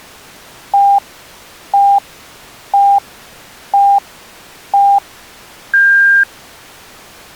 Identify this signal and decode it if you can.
Radio time signal (five pips and a higher one, as on Chinese radio), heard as pips.